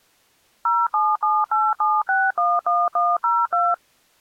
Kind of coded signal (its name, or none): DTMF